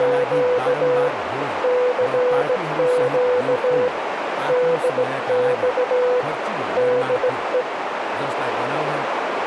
Morse code, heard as a keyed tone, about 17 wpm, 500 Hz, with radio static, a narrow filter and speech in Nepali. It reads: … CQ DX DE